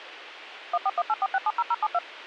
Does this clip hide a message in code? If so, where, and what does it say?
Yes: DTMF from 0.7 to 2.0 s, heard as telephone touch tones, dialled by machine, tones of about 40 ms, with radio hiss and a squelch burst at the end. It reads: 14184670072